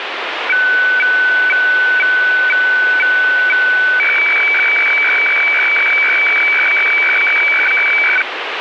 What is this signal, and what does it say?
Weather fax (radiofax), 120 lines a minute, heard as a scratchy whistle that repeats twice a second, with radio static.